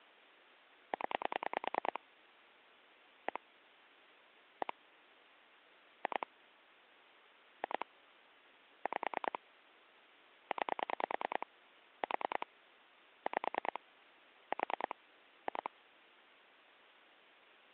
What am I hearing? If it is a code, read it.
Pulse dialling, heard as clicks on a phone line, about 10 pulses a second. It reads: 0 1 1 2 2 5 9 4 5 4 2